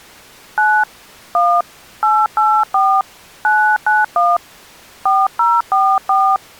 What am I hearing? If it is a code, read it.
DTMF, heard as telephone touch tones, dialled by hand, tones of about 270 ms. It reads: 9 1 884 991 4044